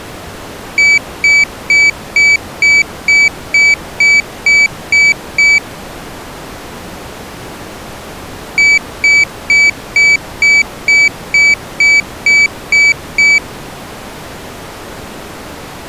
Beep code, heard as a piezo beeper, played twice, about 2300 Hz. 11 short. In AMI BIOS tables: cache memory error.